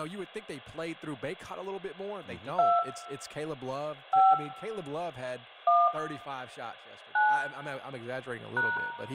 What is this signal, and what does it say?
DTMF, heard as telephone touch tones, dialled by hand, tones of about 210 ms, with hum, room echo and speech in English. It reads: 2 5 1 9 #